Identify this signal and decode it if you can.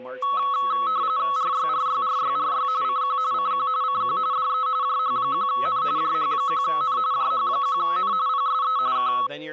RTTY (45.45 baud, 170 Hz shift), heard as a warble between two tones, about 1200 Hz centre, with static crashes, a steady whistle near 510 Hz and speech in English. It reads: RYRYRYRY CQ CQ CQ DE JH1N JH1N JH1N PSE K